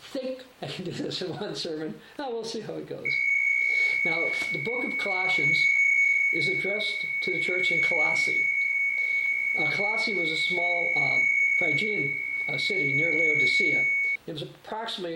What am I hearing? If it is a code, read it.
PSK63 (62.5 baud), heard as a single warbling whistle, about 2200 Hz, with fading and static crashes.